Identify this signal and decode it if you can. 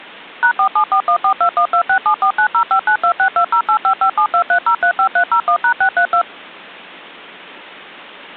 DTMF, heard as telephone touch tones, dialled by machine, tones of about 90 ms. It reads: #4741421267490592620855723035301#632